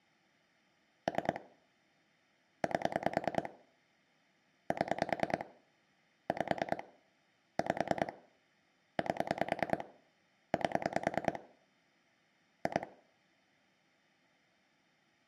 Pulse dialling, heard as clicks on a phone line, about 10 pulses a second, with room echo. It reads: 3 8 7 5 5 8 8 2